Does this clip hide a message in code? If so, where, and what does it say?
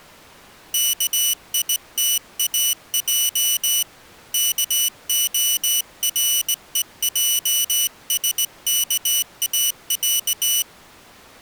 Yes: Morse code (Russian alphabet) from 0.7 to 10.7 s, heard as a high beeper, hand-sent with a straight key, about 19 wpm, 2950 Hz. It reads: КИТАЙ КОРЕЙСКАЯ